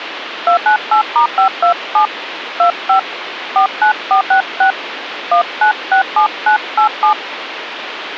DTMF, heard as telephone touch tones, dialled by hand, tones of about 100 ms, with phone line noise. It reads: 298*527 25 49466 1967987